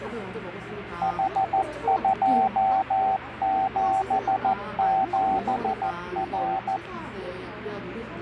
Morse code, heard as a keyed tone, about 14 wpm, 770 Hz, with radio static and the noise of a cafe. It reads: H277R